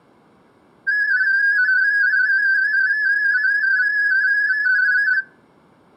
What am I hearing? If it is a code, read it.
Multi-tone FSK (Olivia or MFSK type), about 250 Hz wide, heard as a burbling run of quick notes, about 31.25 baud, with room echo.